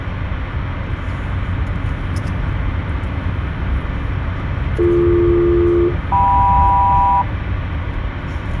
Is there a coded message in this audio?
Yes: aircraft SELCAL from 4.8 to 7.2 s, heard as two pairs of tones, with radio static and the noise inside a car. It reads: BD-KM